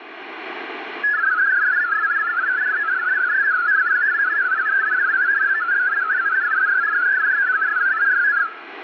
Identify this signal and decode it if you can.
Multi-tone FSK (Olivia or MFSK type), about 500 Hz wide, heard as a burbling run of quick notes, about 62.5 baud.